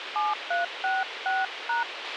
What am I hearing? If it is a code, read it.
DTMF, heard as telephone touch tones, dialled by hand, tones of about 170 ms, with radio hiss and a squelch burst at the end. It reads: 7366#